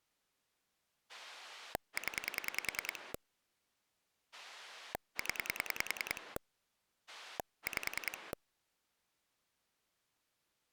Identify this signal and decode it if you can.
Pulse dialling, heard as a rotary dial, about 10 pulses a second. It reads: 0 0 5